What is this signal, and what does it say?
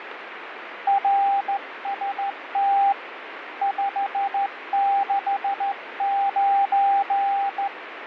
Morse code, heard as a keyed tone, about 14 wpm, 790 Hz, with radio static and fading. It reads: RST 569